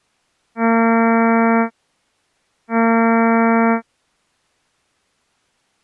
Ship horn signal, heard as a ship's horn, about 230 Hz. 2 short. At sea: I am altering course to port.